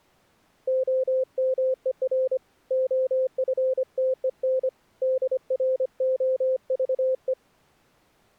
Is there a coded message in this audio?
Yes: Morse code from 0.6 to 7.4 s, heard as a keyed tone, hand-sent with a paddle, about 25 wpm, 520 Hz. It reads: OMER OFTEN DROVE